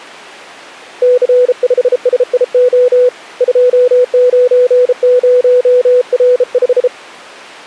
Morse code, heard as a keyed tone, hand-sent with a bug key, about 33 wpm, 500 Hz. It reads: C5SIO 290R5